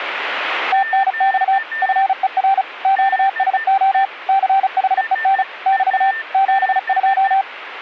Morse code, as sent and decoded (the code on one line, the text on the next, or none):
- -. -..- / ..-. . .-. / --.- ... --- / -.-. .... . -. / -...- / --... ..---
TNX FER QSO CHEN <BT> 72